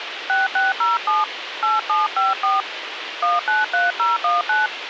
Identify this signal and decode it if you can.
DTMF, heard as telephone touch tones, dialled by hand, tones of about 170 ms, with radio hiss. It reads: 6607 8754 193019